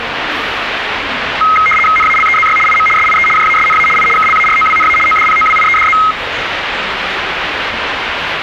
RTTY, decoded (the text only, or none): NALEZY IM SIE JASNA I KLAROWNA ODPOWIEDZ